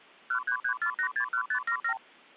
Multi-frequency trunk signalling (R2, with the far end's replies), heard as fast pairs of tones, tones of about 90 ms. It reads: 1334861577